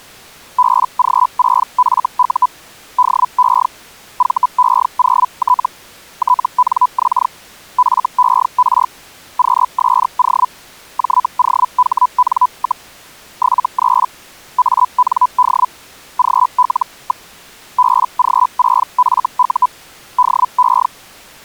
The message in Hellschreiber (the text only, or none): BG6FU DE VE0T TNX FER QSO JOHN, 73 AND GL. BG6FU DE